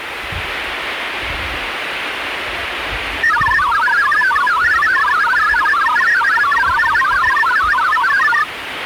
Multi-tone FSK (Olivia or MFSK type), about 1000 Hz wide, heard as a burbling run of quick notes, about 62.5 baud, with radio static and the noise of a park.